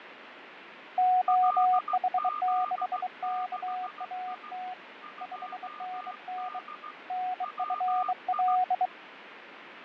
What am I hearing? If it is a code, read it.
Morse code, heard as two keyed tones, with radio static and fading. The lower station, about 23 wpm, 740 Hz: OH6KAT 5NN NFL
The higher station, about 16 wpm, 1210 Hz: LZ6I 2D WI